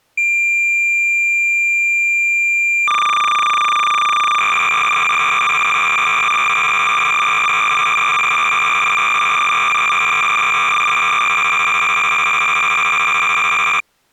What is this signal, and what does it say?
Cassette data (Kansas City type), 300 baud, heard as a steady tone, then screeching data.